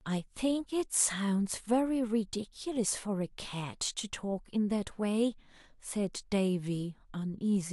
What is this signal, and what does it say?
Speech in English. There is no code.